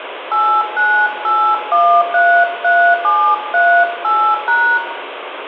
DTMF, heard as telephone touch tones, dialled by hand, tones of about 300 ms, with phone line noise and room echo. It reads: 898133738#